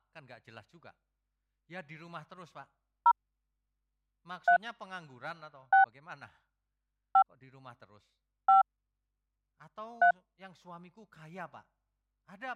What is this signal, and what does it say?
DTMF, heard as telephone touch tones, dialled by hand, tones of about 100 ms, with speech in Indonesian. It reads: 0 3 6 5 5 3